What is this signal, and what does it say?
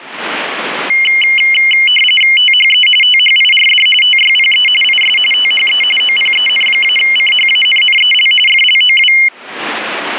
RTTY (45.45 baud, 850 Hz shift), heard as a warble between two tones, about 2550 Hz centre. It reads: THE THIRD TYPE IS THE OPEN-CHANNEL FLOW